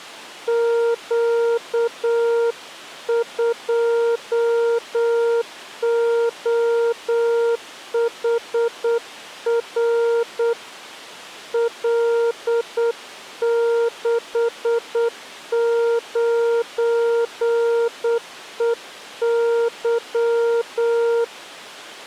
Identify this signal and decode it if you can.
Morse code, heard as a keyed tone, hand-sent with a paddle, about 8 wpm, 470 Hz. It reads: Q2OHR L69EY